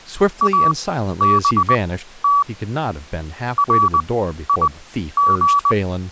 Morse code, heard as a keyed tone, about 20 wpm, spaced as for 12 wpm, 1140 Hz, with speech in English. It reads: ABT RIG